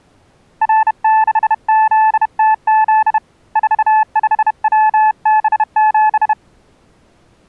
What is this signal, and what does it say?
Morse code, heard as a keyed tone, hand-sent with a bug key, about 31 wpm, 870 Hz. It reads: R6ZTZ 45WB7